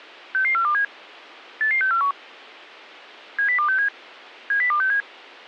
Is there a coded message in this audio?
Yes: five-tone selective call (CCIR) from 0.3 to 5.0 s, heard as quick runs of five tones, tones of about 100 ms. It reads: 66427 88641 70267 70267